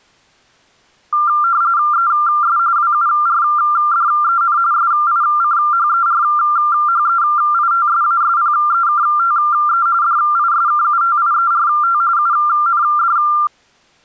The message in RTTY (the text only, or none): ES WURDEN SICHERHEITSASPEKTE DISKUTIERT UND